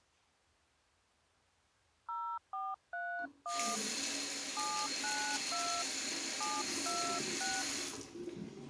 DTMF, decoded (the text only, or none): 0431 792 726